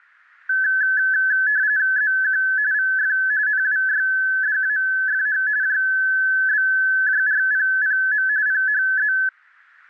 RTTY (45.45 baud, 170 Hz shift), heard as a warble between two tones, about 1600 Hz centre. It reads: ZQ VF NWYDAFH JBJRPPM PHZ